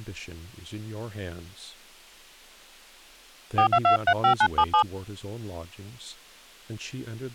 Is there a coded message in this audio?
Yes: DTMF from 3.6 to 4.8 s, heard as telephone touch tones, dialled by hand, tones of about 80 ms, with speech in English. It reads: 42235977